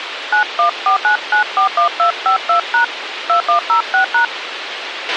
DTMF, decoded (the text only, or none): 9149941252# 2106#